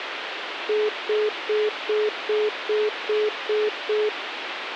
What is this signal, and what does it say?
Telephone call progress tone (single-tone plan, as in most of Europe), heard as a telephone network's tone, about 420 Hz, 0.2 s on and 0.2 s off, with phone line noise. Congestion tone.